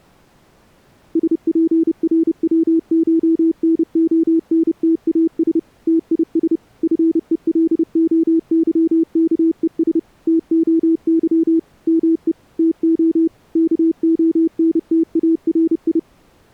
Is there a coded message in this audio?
Yes: Morse code (Greek alphabet) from 1.1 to 16.1 s, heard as a keyed tone, machine-sent, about 30 wpm, 330 Hz. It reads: ΣΠΡΩΧΝΟΝΤΑΣ ΤΙΣ ΦΕΛΟΥΚΕΣ ΤΟΥ ΜΕ ΤΟ ΚΟΝΤΑΡΙ